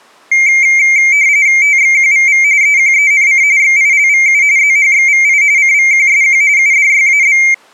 RTTY (45.45 baud, 170 Hz shift), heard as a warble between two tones, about 2200 Hz centre. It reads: TXQVV EQENC XILVU ZHXVI CVQSQ UDYAB